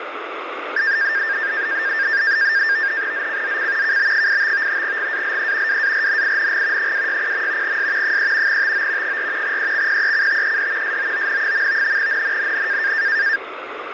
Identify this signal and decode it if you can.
NAVTEX (SITOR-B), 100 baud, 170 Hz shift, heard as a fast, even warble, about 1700 Hz centre, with radio static. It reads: ZCZC KB85 GALE WARNING 260. S 3 TO 4 EXPECTED SOON. NNNN